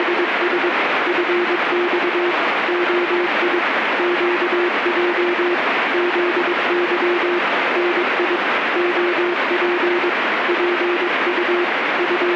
Morse code, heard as a keyed tone, hand-sent with a paddle, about 22 wpm, 350 Hz, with radio static. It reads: … FX OI QJ ZY NI OP PU …